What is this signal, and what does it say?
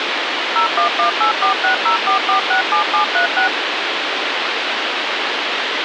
DTMF, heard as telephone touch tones, dialled by machine, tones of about 110 ms, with radio hiss. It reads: 01184604467736